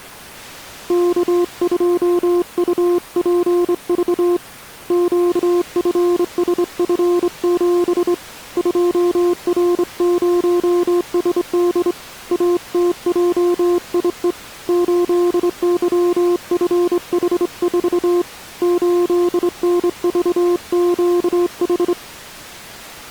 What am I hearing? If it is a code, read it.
Morse code, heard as a keyed tone, hand-sent with a straight key, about 25 wpm, 350 Hz. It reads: K2UPV QFSF7 2R0SD ATJIE 8YFH4 8NVQH